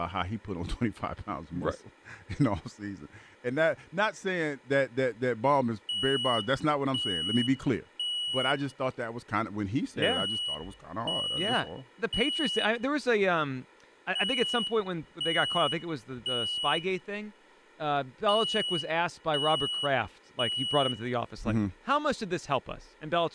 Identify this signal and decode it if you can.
Alarm pattern, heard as an alarm's beeps, played four times, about 2950 Hz, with room echo and speech in English. Temporal three. Smoke or fire, evacuate.